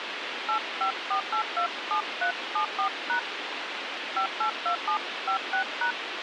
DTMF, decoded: 854827374# 582756#

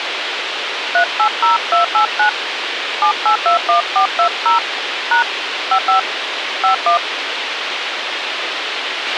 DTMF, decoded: 380289 7821420 # 55 51

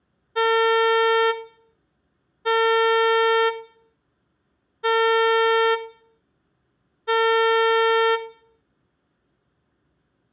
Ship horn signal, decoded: 4 short

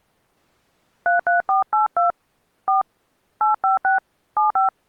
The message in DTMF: 33482 4 856 75

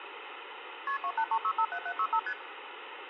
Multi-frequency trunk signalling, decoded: KP 283657765 ST

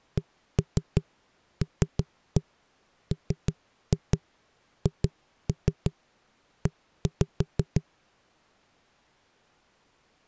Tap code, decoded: CLMHE

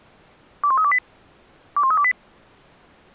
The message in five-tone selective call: 21328 21328

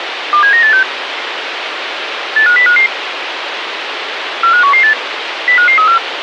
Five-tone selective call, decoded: 27986 85055 45118 05534

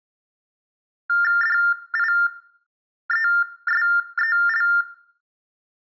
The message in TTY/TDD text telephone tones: DIESEL

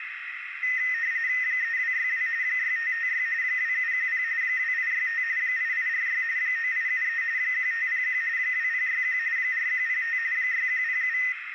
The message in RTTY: 3262 6556 2710 2865 8846 9873 1501 2061 4105 6107

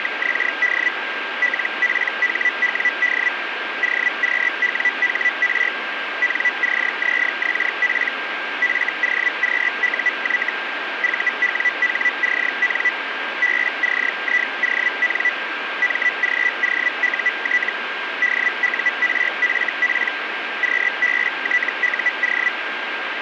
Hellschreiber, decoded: … LPHWD OQWHR NCZXP FOQUY VWHCN BCION MGOUT DURFP QBTUO

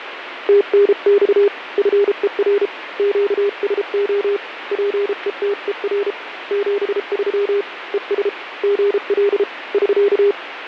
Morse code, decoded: TNX FER QSO PETER 73 ES GL <SK>

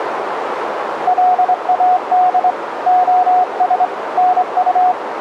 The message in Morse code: LAD OS NU

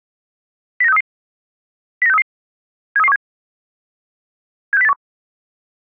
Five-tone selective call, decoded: 09633 09633 73317 76081

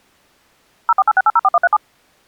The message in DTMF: 0486804137

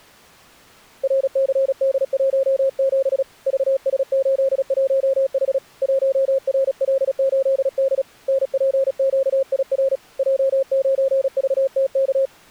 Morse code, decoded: RCD17 VS81H 1RL8D NPQIR J9VTK

